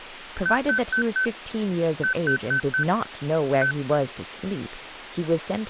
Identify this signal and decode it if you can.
Beep code, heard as beeps from a small speaker, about 1500 Hz, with speech in English. 4-4-1. In Phoenix BIOS tables: serial port failure.